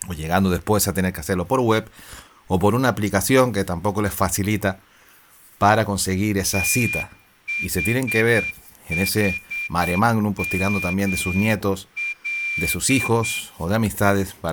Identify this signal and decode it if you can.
Morse code, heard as a whistle, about 8 wpm, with room echo and speech in Spanish. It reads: THHML